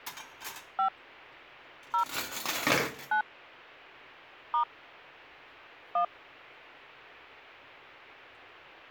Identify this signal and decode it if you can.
DTMF, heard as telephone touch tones, dialled by hand, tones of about 100 ms, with a squelch burst at the end and kitchen noise. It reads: 5 0 9 * 1